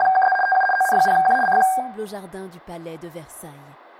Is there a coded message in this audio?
Yes: RTTY (75 baud, 850 Hz shift) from 0.0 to 1.8 s, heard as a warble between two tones, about 1180 Hz centre, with room echo. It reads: … TU ON0Q CQ